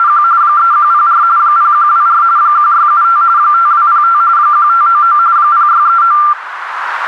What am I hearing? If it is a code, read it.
RTTY (45.45 baud, 170 Hz shift), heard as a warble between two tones, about 1280 Hz centre, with radio static and a narrow filter. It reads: … 3104 0124 1675 5205 1599 0639